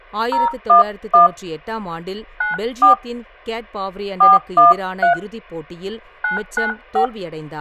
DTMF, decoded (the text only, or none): 011 94 413 995